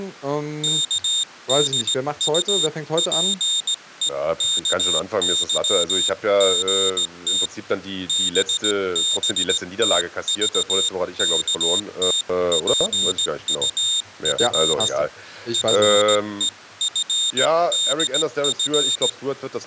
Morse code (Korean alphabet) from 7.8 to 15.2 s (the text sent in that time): 떨어진